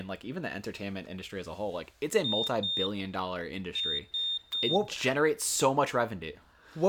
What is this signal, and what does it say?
Beep code, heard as a piezo beeper, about 3650 Hz, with room echo and speech in English. 2-3.